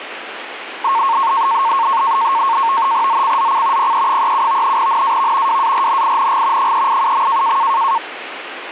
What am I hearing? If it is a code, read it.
NAVTEX (SITOR-B), 100 baud, 170 Hz shift, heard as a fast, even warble, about 1000 Hz centre, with radio static. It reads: ZCZC PE37 NAV WARNING 387.